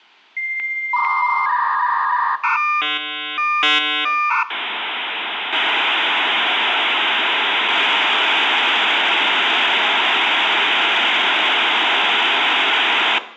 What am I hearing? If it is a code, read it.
Dial-up modem handshake (V.34 or later), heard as a whistle, warbles, then hiss, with room echo.